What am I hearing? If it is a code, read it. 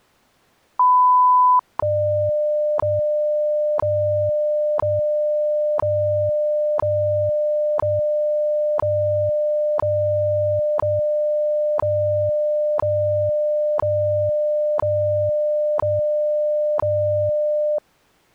Radio time signal (WWV, Colorado), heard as ticks, one a second.